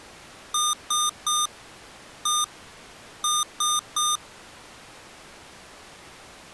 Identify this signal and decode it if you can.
Beep code, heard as beeps from a small speaker, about 1210 Hz. 3-1-3. In Phoenix BIOS tables: interrupt mask register failure.